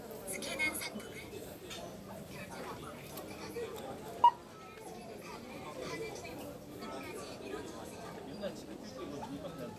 The noise of a crowd indoors. There is no code.